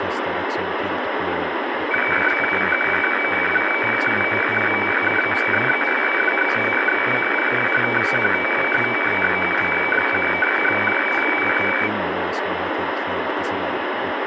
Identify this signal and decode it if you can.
Weather fax (radiofax), 120 lines a minute, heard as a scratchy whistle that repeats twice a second, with radio static and speech in Swedish.